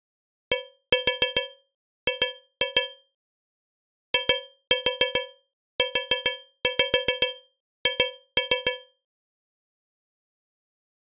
Tap code, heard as taps on a metal pipe, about 7 knocks a second. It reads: DG IUH